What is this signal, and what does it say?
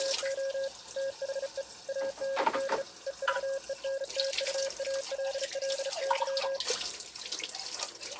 Morse code, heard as a keyed tone, hand-sent with a bug key, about 35 wpm, 540 Hz, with kitchen noise. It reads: … THE AND EVENTUALLY